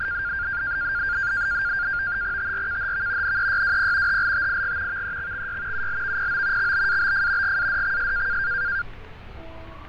NAVTEX (SITOR-B), 100 baud, 170 Hz shift, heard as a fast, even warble, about 1500 Hz centre, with fading, static crashes and street noise. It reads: TRKHV NEYWP HLTIG VEXXY ULVPO XBABF GADXS